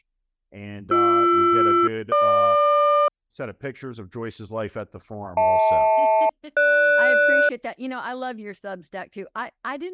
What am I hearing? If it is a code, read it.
Aircraft SELCAL, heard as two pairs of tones, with speech in English. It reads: BR-GQ HL-GS